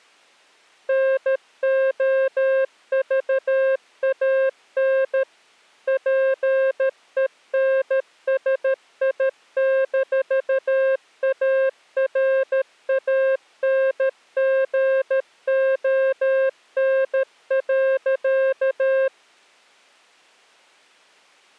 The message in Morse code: NOVAN PENSI-ARANGON.

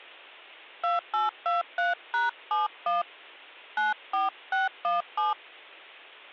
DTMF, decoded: 2823#71 94617

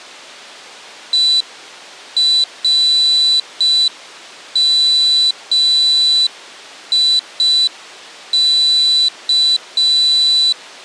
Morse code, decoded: ERMIK

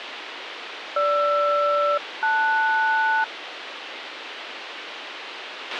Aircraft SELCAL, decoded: GR-LS

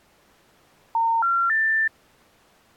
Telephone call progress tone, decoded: special information tone

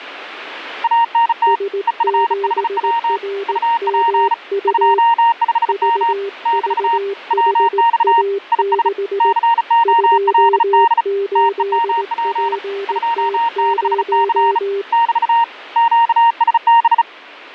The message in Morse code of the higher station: ANT EFHW UP 25M <BT> WX IS COLD TEMP 26C <BT> QSB

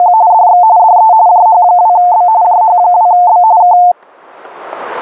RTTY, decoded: … DX DE JH2B JH2B K

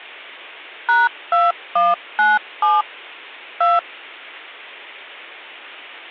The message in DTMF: #2197 2

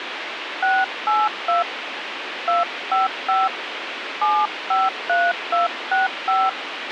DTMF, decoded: 682 255 753265

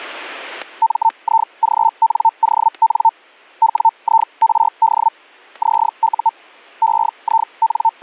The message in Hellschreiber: MIGNON WIRD ZU …

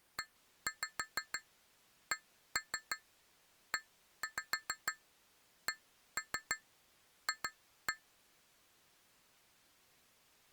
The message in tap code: ECECF

